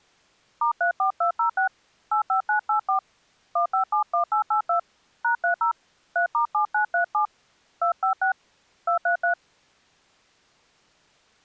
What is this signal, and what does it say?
DTMF, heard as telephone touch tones, dialled by hand, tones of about 110 ms. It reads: *34206 85984 1571882 #30 3*7937 256 233